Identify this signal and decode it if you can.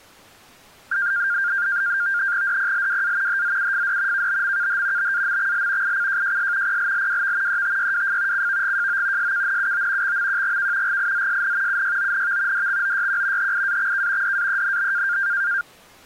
NAVTEX (SITOR-B), 100 baud, 170 Hz shift, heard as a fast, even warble, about 1500 Hz centre. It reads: DPLWA HZUFD KBMKH BAMXL ICJJS PLLWV ETYWF CVGJO SKNUO XMQGK GIZSN UYONV DXOYQ HIAXK DAENB